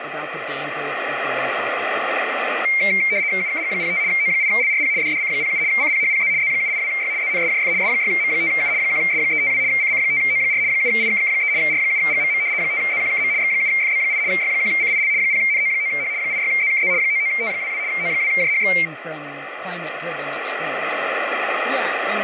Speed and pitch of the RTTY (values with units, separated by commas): 75 baud, 170 Hz shift, 2200 Hz centre